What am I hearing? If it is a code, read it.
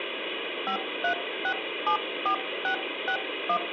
DTMF, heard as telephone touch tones, dialled by hand, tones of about 90 ms, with phone line noise. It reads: 53674661